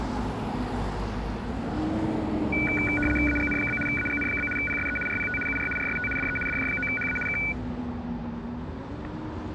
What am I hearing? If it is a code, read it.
RTTY (75 baud, 850 Hz shift), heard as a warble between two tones, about 1900 Hz centre, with static crashes and street noise. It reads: AGN? AGN? PSE RPT UR RST DE DJ9HA K